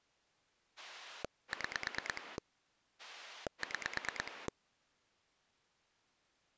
Pulse dialling, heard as a rotary dial, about 9 pulses a second. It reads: 6 6